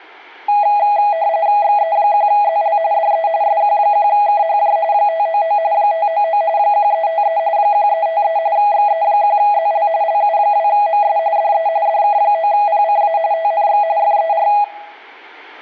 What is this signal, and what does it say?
RTTY (45.45 baud, 170 Hz shift), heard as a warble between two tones, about 740 Hz centre, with room echo. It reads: XE1ZL DE SQ1KHJ 599 599 1353 1353 XE1ZL LU2MS DE DK9PCA TNX FER